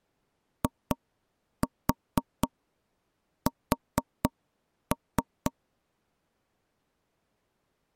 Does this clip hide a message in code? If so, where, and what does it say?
Yes: tap code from 0.6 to 5.5 s, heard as knocks on wood, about 4 knocks a second. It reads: IS